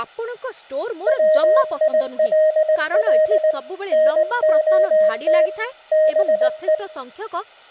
Morse code, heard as a keyed tone, hand-sent with a paddle, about 19 wpm, 620 Hz, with speech in Odia. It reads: WILL NOT BE